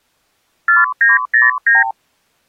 Multi-frequency trunk signalling (R2, with the far end's replies), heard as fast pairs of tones, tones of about 160 ms. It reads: 4909